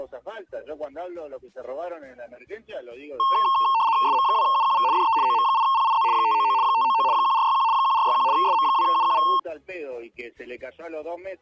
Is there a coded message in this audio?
Yes: RTTY (75 baud, 170 Hz shift) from 3.2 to 9.4 s, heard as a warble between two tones, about 990 Hz centre. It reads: SM2UQV DE OM8PIZ 599 599 1461 1461 SM2UQV